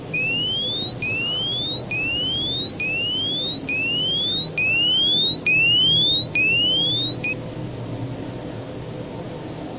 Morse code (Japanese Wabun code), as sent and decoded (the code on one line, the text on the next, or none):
none